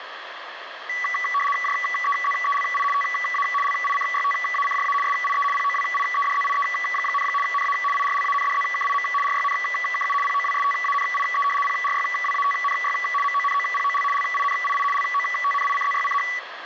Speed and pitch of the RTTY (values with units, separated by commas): 75 baud, 850 Hz shift, 1550 Hz centre